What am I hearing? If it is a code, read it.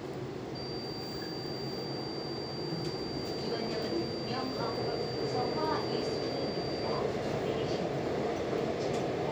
A steady tone, with the noise inside a subway train. There is no code.